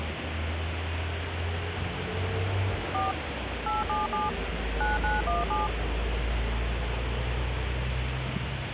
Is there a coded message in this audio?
Yes: DTMF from 2.9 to 5.7 s, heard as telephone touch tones, dialled by machine, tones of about 170 ms, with phone line noise and street noise. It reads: 4 877 9917